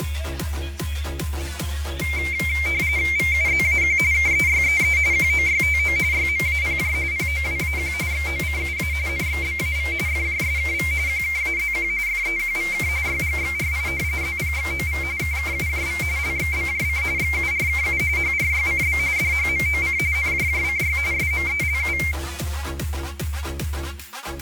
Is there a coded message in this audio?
Yes: RTTY (45.45 baud, 170 Hz shift) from 2.0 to 22.1 s, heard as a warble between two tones, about 2200 Hz centre, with fading and static crashes. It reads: VUZAQ KEYEE QOYTO YMAPJ POWAQ XOCUA NXBAV FJSKV QKAZQ FEQVK YGXRI ZPXOV KKUJV LXBJC XURKU HRYCB DHMOC NJJCY SMELU